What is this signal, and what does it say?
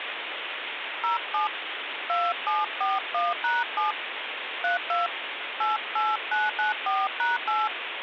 DTMF, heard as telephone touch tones, dialled by hand, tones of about 170 ms, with phone line noise. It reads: 07 2741#7 32 88994#8